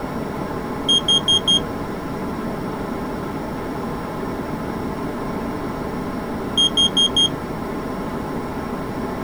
Alarm pattern, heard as an alarm's beeps, played twice, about 3250 Hz. Temporal four. Carbon monoxide.